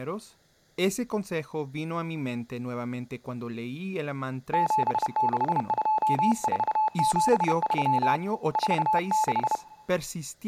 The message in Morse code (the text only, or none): 762473 46